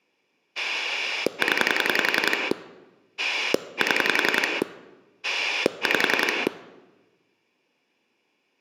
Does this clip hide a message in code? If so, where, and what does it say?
Yes: pulse dialling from 0.6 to 6.5 s, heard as a rotary dial, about 11 pulses a second. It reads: 0 7 5